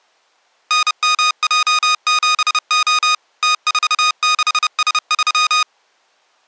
Morse code, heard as electronic beeps, machine-sent, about 30 wpm, 1240 Hz. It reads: NMJ7O T46S3